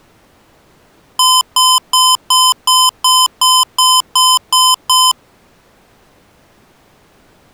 Beep code, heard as beeps from a small speaker, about 1020 Hz. 11 short. In AMI BIOS tables: cache memory error.